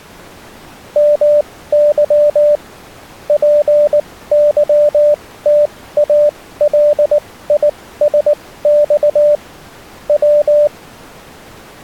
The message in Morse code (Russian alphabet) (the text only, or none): МЫ ПЫТАЛИСЬ В